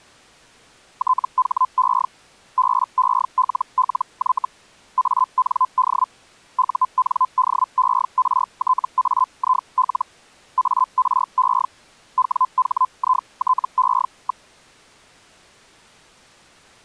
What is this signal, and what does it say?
Hellschreiber (Feld-Hell, 122.5 baud), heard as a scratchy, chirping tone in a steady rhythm, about 1020 Hz. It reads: THE BELLY AND UNDERTAIL ARE WHITE.